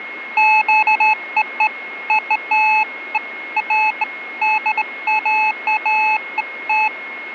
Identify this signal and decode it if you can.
Beeps of irregular length, with a steady whistle near 2160 Hz. There is no code.